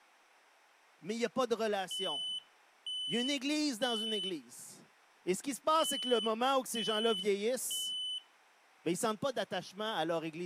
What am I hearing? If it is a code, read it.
Alarm pattern, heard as an alarm's beeps, played twice, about 3000 Hz, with room echo and speech in French. Temporal three. Smoke or fire, evacuate.